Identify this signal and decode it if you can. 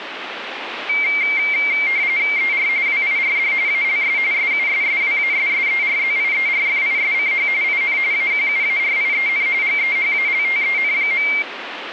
RTTY (45.45 baud, 170 Hz shift), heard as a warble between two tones, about 2200 Hz centre, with radio static. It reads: ER WIRD ALS SUSSWASSERZIERFISCH IN AQUARIEN GEHALTEN.